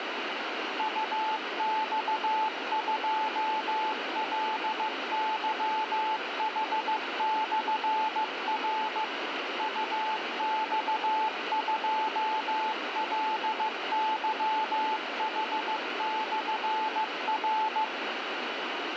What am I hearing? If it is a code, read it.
Morse code, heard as a keyed tone, machine-sent, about 15 wpm, 870 Hz, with radio static. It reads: UX2LYH/R UX2LYH/R